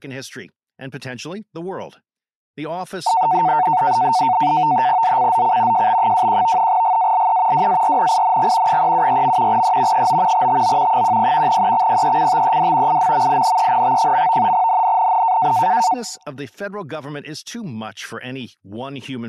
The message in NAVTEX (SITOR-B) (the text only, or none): ZCZC JB21 GALE WARNING 374. E 9 TO 10 EXPECTED IMMINENT. NNNN